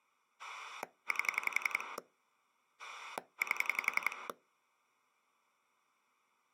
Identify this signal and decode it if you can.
Pulse dialling, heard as a rotary dial, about 11 pulses a second. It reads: 8 8